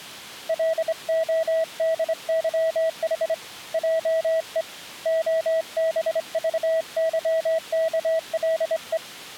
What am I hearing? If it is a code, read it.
Morse code, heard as a keyed tone, hand-sent with a straight key, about 25 wpm, 650 Hz. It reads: LODYH JE OBVYKLE